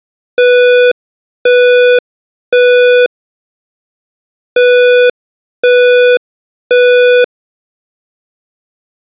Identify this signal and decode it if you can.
Alarm pattern, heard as an alarm's beeps, played twice, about 490 Hz. Temporal three. Smoke or fire, evacuate.